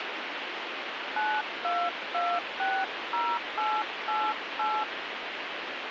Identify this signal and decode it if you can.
DTMF, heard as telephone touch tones, dialled by hand, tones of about 240 ms, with radio hiss. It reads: 92260888